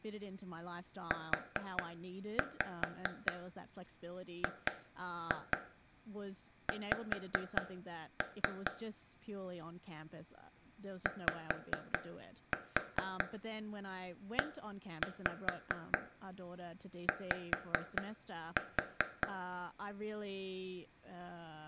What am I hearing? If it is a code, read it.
Tap code, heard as taps on a table, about 4 knocks a second, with room echo and speech in English. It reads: UGX YEY